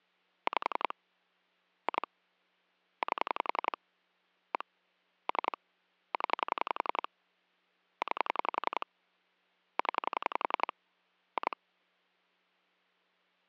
Pulse dialling, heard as clicks on a phone line, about 11 pulses a second. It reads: 5 2 8 1 3 0 9 0 2